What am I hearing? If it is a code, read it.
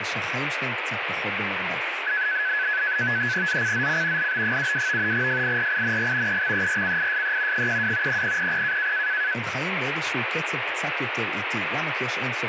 NAVTEX (SITOR-B), 100 baud, 170 Hz shift, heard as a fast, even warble, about 1600 Hz centre, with radio static and speech in Hebrew. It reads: ZCZC LB72 FIRING EXERCISE 12 0000